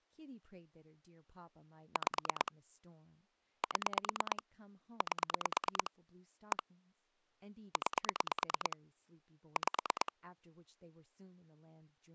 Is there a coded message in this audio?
Yes: pulse dialling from 2.0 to 10.1 s, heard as clicks on a phone line, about 9 pulses a second, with speech in English. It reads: 5 7 8 1 9 5